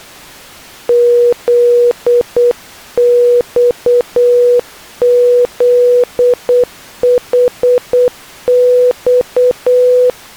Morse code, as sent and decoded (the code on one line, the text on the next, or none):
--.. -..- --.. .... -..-
ZXZHX